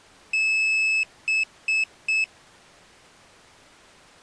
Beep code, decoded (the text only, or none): 1 long, 3 short